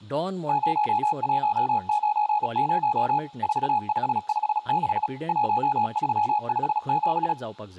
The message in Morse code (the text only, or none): 0190 4556 1357